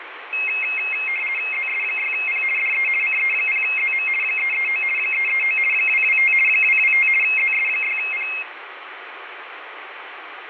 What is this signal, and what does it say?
RTTY (50 baud, 450 Hz shift), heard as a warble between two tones, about 2350 Hz centre, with radio static and fading. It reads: ZS6P DE CE0ZM 339 339 225 225 ZS6P